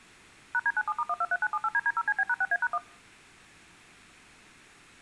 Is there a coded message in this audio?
Yes: DTMF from 0.5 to 2.8 s, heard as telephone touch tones, dialled by machine, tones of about 50 ms. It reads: #D97*123978DD0CB#6A#1